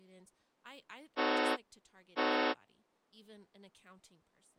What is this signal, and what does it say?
Train horn signal, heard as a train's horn, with speech in English. 2 short. On North American railways: a signal is acknowledged.